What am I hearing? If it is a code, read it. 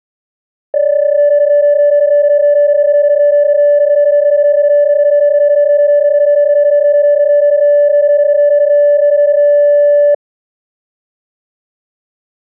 PSK31 (31.25 baud), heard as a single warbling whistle, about 580 Hz.